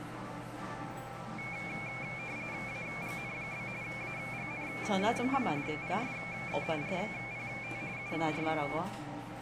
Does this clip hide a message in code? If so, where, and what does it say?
Yes: RTTY (45.45 baud, 170 Hz shift) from 1.4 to 8.8 s, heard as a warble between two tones, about 2300 Hz centre, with the noise of a cafe. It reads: AGN? AGN? PSE RPT UR